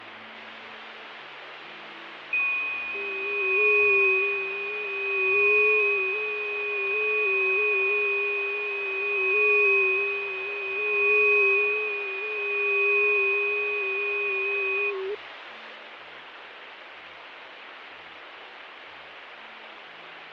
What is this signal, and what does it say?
FT8 (several signals at once), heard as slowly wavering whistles, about 6.25 baud, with radio static and fading.